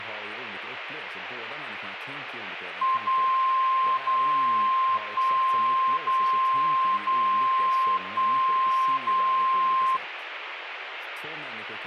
Radio time signal (DCF77), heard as a tone whose level steps once a second, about 1050 Hz, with radio static and speech in Swedish. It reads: 0 0 1 0 0 1 0